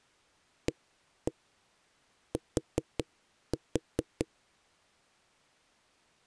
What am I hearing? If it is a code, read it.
Tap code, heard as knocks on wood, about 5 knocks a second. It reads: AT